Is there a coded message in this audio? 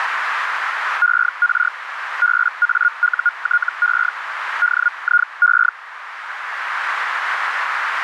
Yes: Hellschreiber (Feld-Hell, 122.5 baud) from 1.0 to 5.7 s, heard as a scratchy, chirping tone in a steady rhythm, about 1430 Hz, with radio static and a narrow filter. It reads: ER BAUTE DIE